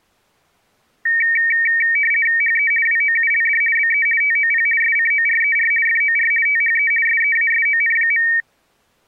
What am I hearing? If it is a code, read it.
RTTY (50 baud, 450 Hz shift), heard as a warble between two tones, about 2050 Hz centre. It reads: HE WOULD BE TOP SCORER FOR THE SEASON.